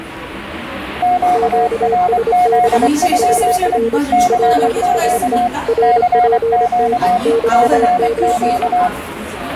Morse code, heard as two keyed tones, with the noise of a cafe. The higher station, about 24 wpm, 720 Hz: QRZ? CQ CQ CQ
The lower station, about 26 wpm, 460 Hz: QSB HR PSE RPT NAME